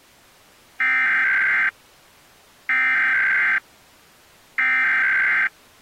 Emergency Alert System (SAME) tones (header bursts), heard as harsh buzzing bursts, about 520.83 baud.